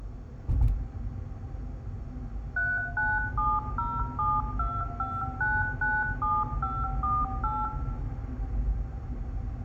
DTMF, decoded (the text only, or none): 3970725997548